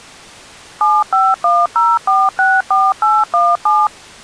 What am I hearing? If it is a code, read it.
DTMF, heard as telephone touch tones, dialled by machine, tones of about 220 ms. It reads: 7510464817